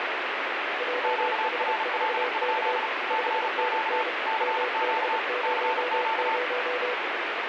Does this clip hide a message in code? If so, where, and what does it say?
Yes: Morse code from 0.7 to 7.0 s, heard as two keyed tones, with heavy radio static. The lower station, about 30 wpm, 500 Hz: JH4K 5NN MB00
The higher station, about 35 wpm, 880 Hz: QRL? CQ CQ CQ